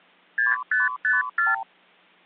Multi-frequency trunk signalling (R2, with the far end's replies), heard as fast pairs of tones, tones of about 170 ms. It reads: 6554